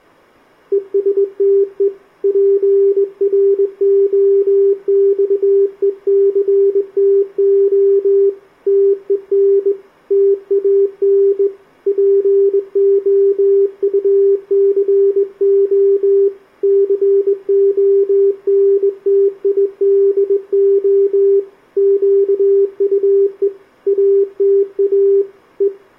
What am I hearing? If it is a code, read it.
Morse code, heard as a keyed tone, hand-sent with a straight key, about 20 wpm, 400 Hz, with room echo. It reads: ESTE PROXECTO TEN TAN POUCO CONTIDO QUE ATA E